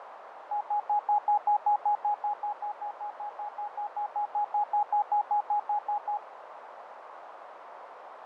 Evenly repeated beeps, with radio static, fading and a narrow filter. There is no code.